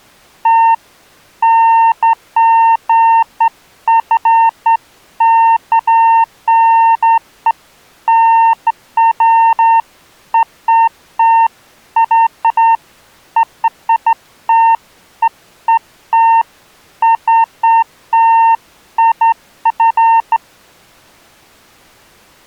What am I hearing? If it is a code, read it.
Beeps of irregular length. There is no code.